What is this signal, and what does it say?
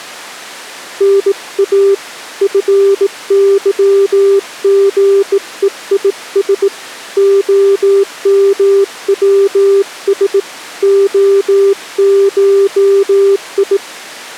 Morse code (Greek alphabet), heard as a keyed tone, hand-sent with a bug key, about 18 wpm, 400 Hz. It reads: ΝΑ ΦΥΓΕΙΣ ΟΜΩΣ ΟΧΙ